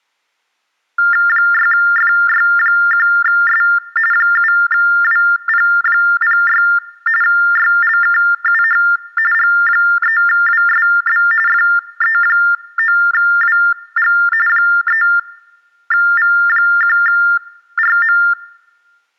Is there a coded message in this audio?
Yes: TTY/TDD text telephone tones (45.45 baud Baudot) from 1.0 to 18.3 s, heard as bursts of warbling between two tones, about 400 Hz shift, 1600 Hz centre. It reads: 6FY1S 7WP06 YLKUH G3WSB FE9WG 3V1RM